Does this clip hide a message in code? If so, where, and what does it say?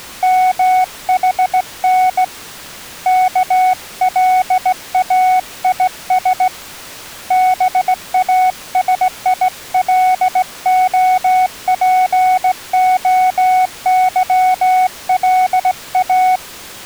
Yes: Morse code (Greek alphabet) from 0.2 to 16.4 s, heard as a keyed tone, hand-sent with a straight key, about 17 wpm, 740 Hz. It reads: ΜΗΝ ΚΛΑΙΣ ΒΑΣΙΛΟΠΟΥΛΑ